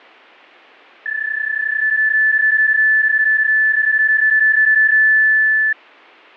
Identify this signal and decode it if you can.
PSK31 (31.25 baud), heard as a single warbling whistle, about 1750 Hz.